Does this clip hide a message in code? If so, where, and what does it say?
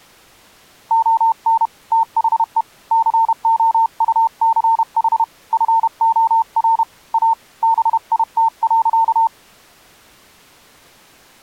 Yes: Morse code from 0.8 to 9.3 s, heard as a keyed tone, hand-sent with a paddle, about 31 wpm, 900 Hz. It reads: ON THE COUCH FOR A BIT.